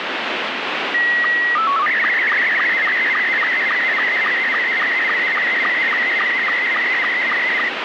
SSTV (slow-scan television), Scottie S2, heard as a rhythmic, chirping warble, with heavy radio static.